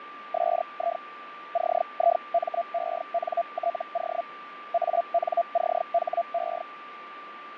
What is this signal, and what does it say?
Hellschreiber (Feld-Hell, 122.5 baud), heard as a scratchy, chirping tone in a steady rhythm, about 680 Hz, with radio static, fading and a steady whistle near 1180 Hz. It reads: SI CIMENTO ANCHE